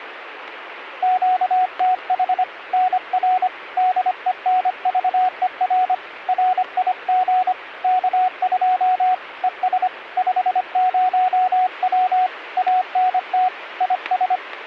Morse code, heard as a keyed tone, hand-sent with a paddle, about 25 wpm, 740 Hz, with radio static. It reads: QTH NR DENVER RIG K2 ES 50W ANT IS